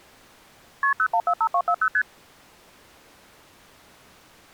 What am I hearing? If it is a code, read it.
Multi-frequency trunk signalling (R1, as on North American trunks), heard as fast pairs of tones, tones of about 70 ms. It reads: KP 0145240 ST